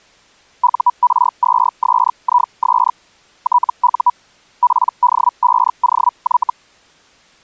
Hellschreiber (Feld-Hell, 122.5 baud), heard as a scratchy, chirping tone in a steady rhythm, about 980 Hz. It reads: UR2SIS TU PD5OY